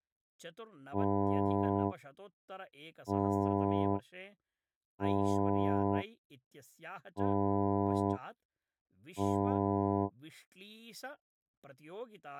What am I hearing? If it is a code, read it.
Ship horn signal, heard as a ship's horn, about 100 Hz, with speech in Sanskrit. 5 short. At sea: I doubt that you are doing enough to avoid a collision.